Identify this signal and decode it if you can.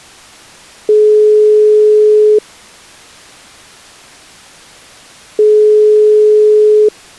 Telephone call progress tone (single-tone plan, as in most of Europe), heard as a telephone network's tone, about 420 Hz, 1.5 s on and 3 s off. Ringback tone.